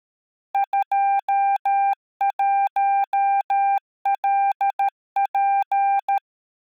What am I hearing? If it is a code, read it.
Morse code, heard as a keyed tone, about 13 wpm, 790 Hz. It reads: 21LP